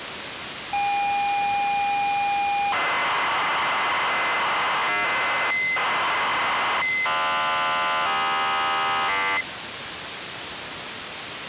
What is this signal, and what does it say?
ZX Spectrum tape loading, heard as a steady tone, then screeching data, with tape hiss.